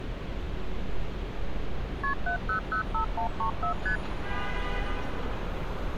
Multi-frequency trunk signalling (R1, as on North American trunks), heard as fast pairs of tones, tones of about 100 ms, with street noise. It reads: KP 7005134 ST